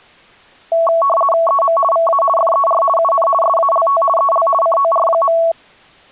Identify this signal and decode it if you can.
RTTY (50 baud, 450 Hz shift), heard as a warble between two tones, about 890 Hz centre. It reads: EM VA FER UN SALT EL COR.